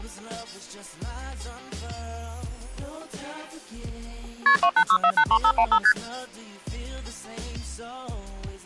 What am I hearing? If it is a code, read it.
Multi-frequency trunk signalling (R1, as on North American trunks), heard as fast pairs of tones, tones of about 70 ms. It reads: KP 286483515 ST